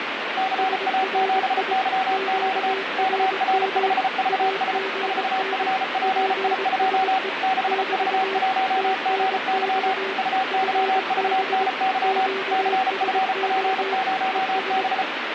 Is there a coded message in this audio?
Yes: Morse code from 0.3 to 15.1 s, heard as two keyed tones, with radio static. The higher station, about 34 wpm, 760 Hz: CA7YQ KR5VS 4FPI2 6V1GY UYVNY CFP0B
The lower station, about 22 wpm, 390 Hz: SRI QRM AGN PSE <BT> TNX FB QSO ES